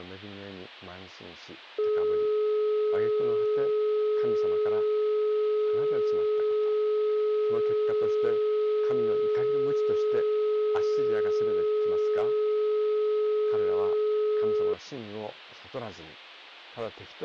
Telephone call progress tone (425 Hz plan, as in most of Europe), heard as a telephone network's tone, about 420 Hz. Dial tone.